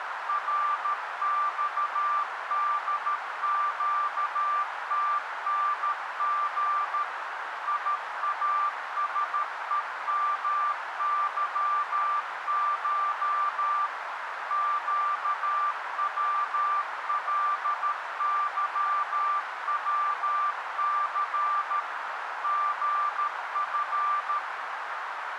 Morse code (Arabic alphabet), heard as a keyed tone, machine-sent, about 13 wpm, 1180 Hz, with radio static and a narrow filter. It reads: رصدقتنغ ياسءمظش قولظوث غف